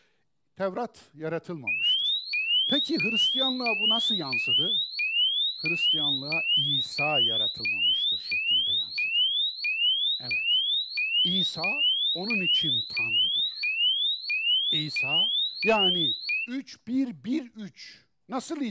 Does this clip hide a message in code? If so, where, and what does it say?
No, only a tone that sweeps in pitch again and again, with speech in Turkish.